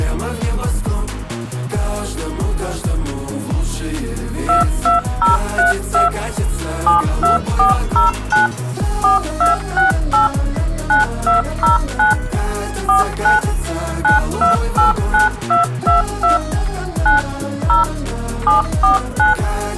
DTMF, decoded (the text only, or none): 22032 72409 4268 9209 49 9289222 9 0 749